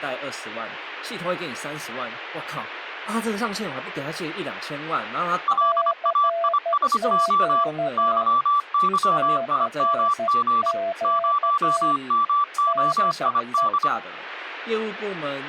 Morse code, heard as two keyed tones, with speech in Chinese. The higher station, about 25 wpm, 1160 Hz: LAISO YYIMG 0MOID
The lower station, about 12 wpm, 670 Hz: CQ CQ DE